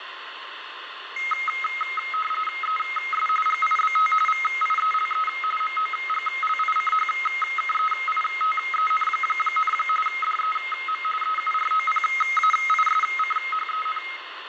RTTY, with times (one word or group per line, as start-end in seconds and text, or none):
2.6-3.3 ES
3.5-4.1 GIBT
4.3-5.3 VIELE
5.6-9.7 MOGLICHKEITEN,
10.1-11.0 DEM
11.2-14.0 EUROPAISCHEN